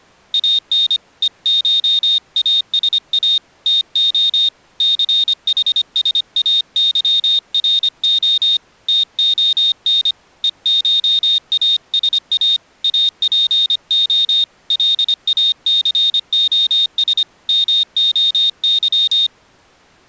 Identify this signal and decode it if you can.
Morse code (Greek alphabet), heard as a high beeper, hand-sent with a paddle, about 25 wpm, 3700 Hz. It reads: ΑΝ ΕΧΑΣΑ ΤΟ ΘΗΣΑΥΡΟ ΤΟΝ ΕΧΑΣΑ ΑΠΟ ΛΑΘΟΣ ΜΟΥ